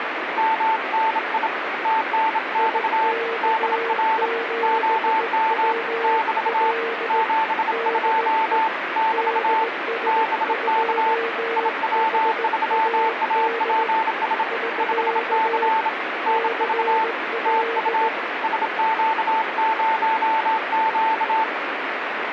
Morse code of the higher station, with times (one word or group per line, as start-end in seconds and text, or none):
0.4-1.5 MNI
1.9-3.1 TNX
3.4-4.3 DR
4.6-5.7 OM
6.0-6.7 <BT>
7.1-8.7 72
9.0-9.6 <BT>
10.1-11.1 BK
11.6-14.4 IW3APS
14.8-15.9 5C
16.3-17.0 NV
17.5-18.1 TU
18.4-21.4 SQ0Q